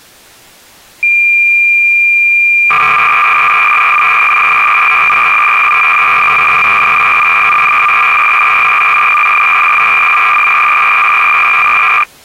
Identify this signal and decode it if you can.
Cassette data (Kansas City type), 300 baud, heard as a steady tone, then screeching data.